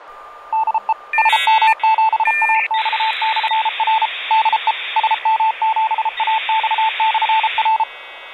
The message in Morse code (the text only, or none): DE SM7AX/R DE SM7AX/R